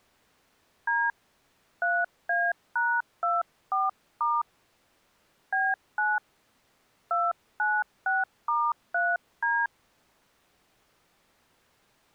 DTMF, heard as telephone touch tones, dialled by hand, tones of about 210 ms. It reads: D 3A#24* B9 296*3D